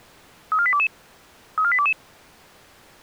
Five-tone selective call (ZVEI), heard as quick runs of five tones, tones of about 70 ms. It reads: 34822 34822